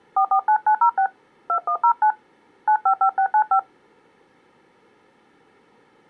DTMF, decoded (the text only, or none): 449906 2109 955695